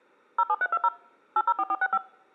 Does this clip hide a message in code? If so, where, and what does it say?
Yes: DTMF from 0.4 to 2.0 s, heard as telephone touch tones, dialled by machine, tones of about 50 ms. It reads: 07320 804465